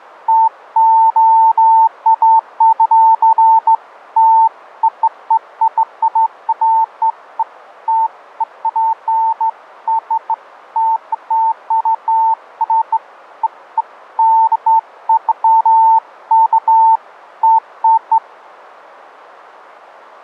Beeps of irregular length. There is no code.